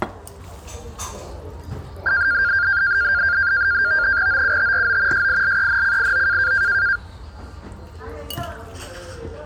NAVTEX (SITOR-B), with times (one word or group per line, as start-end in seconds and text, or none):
4.3-5.3 OUTRO
5.1-6.5 SILENCIO